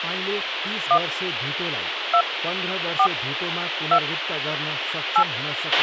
DTMF, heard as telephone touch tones, dialled by hand, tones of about 80 ms, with radio hiss, a squelch burst at the end and speech in Nepali. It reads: 1 2 4 2 8